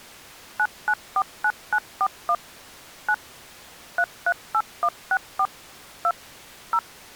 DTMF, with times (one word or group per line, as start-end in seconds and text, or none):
0.6-2.3 9949941
3.1-3.1 9
4.0-5.5 338164
6.0-6.1 2
6.7-6.8 0